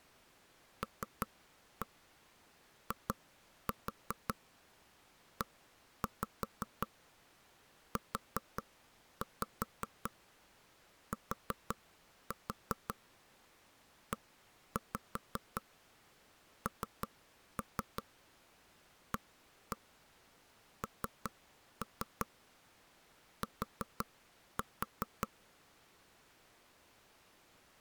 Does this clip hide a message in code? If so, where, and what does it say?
Yes: tap code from 0.8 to 25.3 s, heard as knocks on wood, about 5 knocks a second. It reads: LIEUTENANT